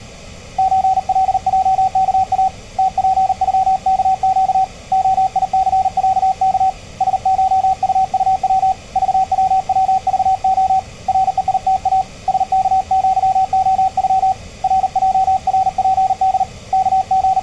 Morse code (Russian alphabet), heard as a keyed tone, hand-sent with a paddle, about 39 wpm, 760 Hz, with room echo. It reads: ЧЛЙКА ТПЮКЩ ОИЦЯК СШУУВ ЖВВЖО РЕИТА СКЪОЮ РЙРПД …